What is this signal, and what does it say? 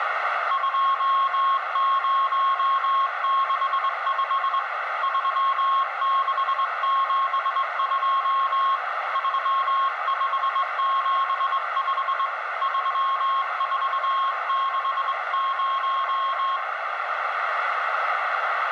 Morse code, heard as a keyed tone, hand-sent with a straight key, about 22 wpm, 1080 Hz, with radio static, a narrow filter and room echo. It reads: 2065 3672 3575 3460